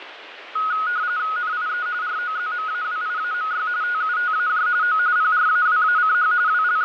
RTTY (45.45 baud, 170 Hz shift), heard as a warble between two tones, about 1360 Hz centre, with radio static. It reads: NIE ROZMAWIAMY TUTAJ O PRAWACH …